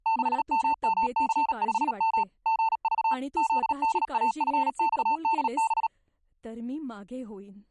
Morse code, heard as a keyed tone, machine-sent, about 37 wpm, 900 Hz, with speech in Marathi. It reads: 6MMC5M GV ZDAFXDB